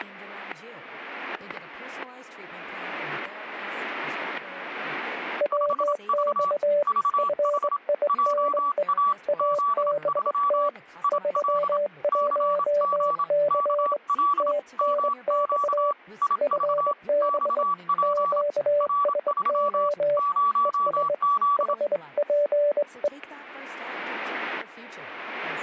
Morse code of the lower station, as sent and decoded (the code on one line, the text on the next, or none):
.-- -..- / ..-. .. -. . / .- -... - / ...-- .---- -.-. / - -. -..- / ..-. -... / --.- ... --- / . ... / .... .--. .
WX FINE ABT 31C TNX FB QSO ES HPE